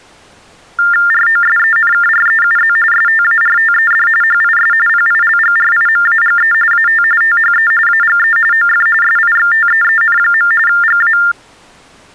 TTY/TDD text telephone tones (45.45 baud Baudot), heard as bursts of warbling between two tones, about 400 Hz shift, 1600 Hz centre. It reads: ROSENKREUZ STARTED HIS PILGRIMAGE AT THE AGE OF SIXTEEN. GA